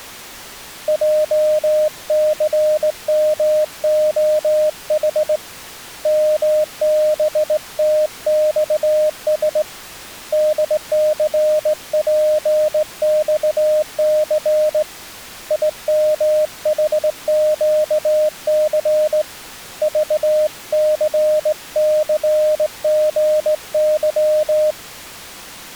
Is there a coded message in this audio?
Yes: Morse code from 0.8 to 24.8 s, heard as a keyed tone, hand-sent with a straight key, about 18 wpm, 610 Hz. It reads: JCMOH MBTXS DCPXC IMHQC VCCGY